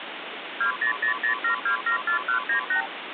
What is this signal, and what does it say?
Multi-frequency trunk signalling (R2, with the far end's replies), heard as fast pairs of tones, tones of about 100 ms, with phone line noise. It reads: 20007274198